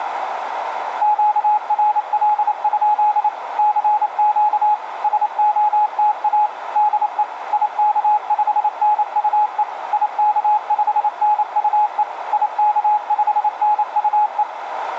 Morse code, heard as a keyed tone, machine-sent, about 28 wpm, 840 Hz, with radio static and a narrow filter. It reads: QRL? CQ SOTA DE IK5NUE IK5NUE IK5NUE